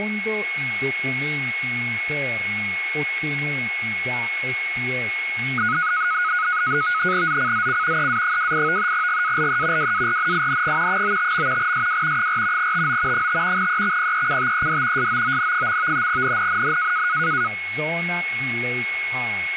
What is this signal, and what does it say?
NAVTEX (SITOR-B), 100 baud, 170 Hz shift, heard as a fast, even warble, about 1360 Hz centre, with a steady whistle near 2190 Hz and speech in Italian. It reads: ZCZC EA28 GALE WARNING 95. SW 4 TO 5 EXPECTED SOON. NNNN